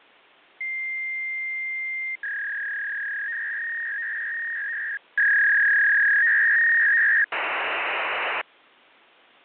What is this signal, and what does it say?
Fax machine handshake, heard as a long tone, a warble and hiss.